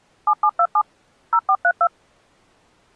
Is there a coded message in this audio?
Yes: DTMF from 0.3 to 1.9 s, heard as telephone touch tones, dialled by machine, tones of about 60 ms. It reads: 7727 0432